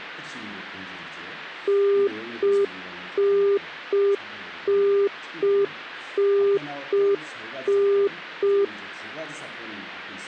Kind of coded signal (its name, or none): telephone call progress tone